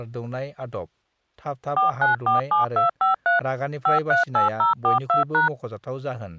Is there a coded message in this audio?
Yes: DTMF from 1.8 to 5.5 s, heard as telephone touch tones, dialled by machine, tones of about 130 ms, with speech in Bodo. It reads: 4947253 538042#